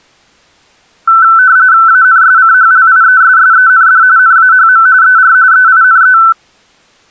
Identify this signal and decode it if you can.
RTTY (45.45 baud, 170 Hz shift), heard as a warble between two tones, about 1420 Hz centre. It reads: ANSCHLIESSEND NAHM ER EINE